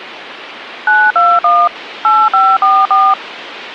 DTMF, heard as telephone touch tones, dialled by machine, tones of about 230 ms, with phone line noise. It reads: 921 8544